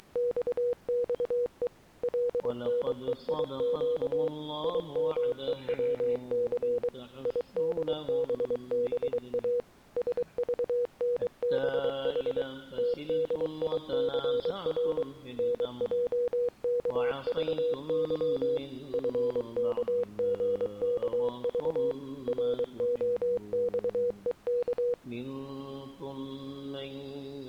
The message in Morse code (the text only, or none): … LNEIQ IMEWC IDBBA SVNBH TDICR NJKVY FKGKV ROXEK